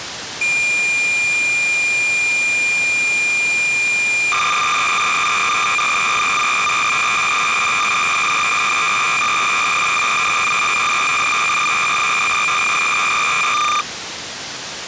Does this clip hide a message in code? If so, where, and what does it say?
Yes: cassette data (Kansas City type), 300 baud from 0.4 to 13.8 s, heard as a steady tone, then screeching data, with tape hiss.